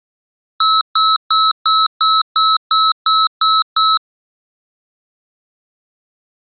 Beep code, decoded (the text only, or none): 10 short